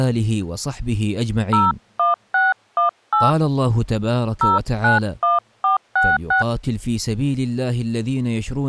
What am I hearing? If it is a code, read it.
DTMF, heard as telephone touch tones, dialled by hand, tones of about 160 ms. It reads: 01618 091466